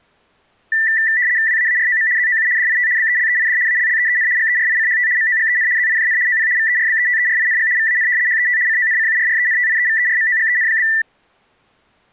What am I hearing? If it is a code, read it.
RTTY (75 baud, 170 Hz shift), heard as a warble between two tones, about 1850 Hz centre. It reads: WAAROM ZOU DIT BELEID ALLEEN GERICHT MOGEN ZIJN OP VERBETERING VAN HET CONCURRENTIEVERMOGEN?